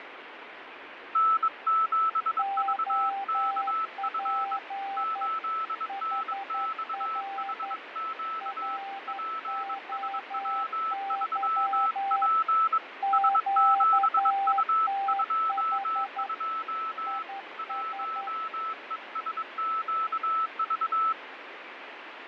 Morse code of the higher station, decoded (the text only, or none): N7VKF 8NXHQ PSW3P S7U22 1ESQV